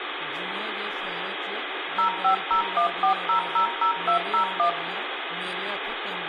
DTMF, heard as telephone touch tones, dialled by machine, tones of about 100 ms, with phone line noise, room echo and speech in Dogri. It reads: 05014000201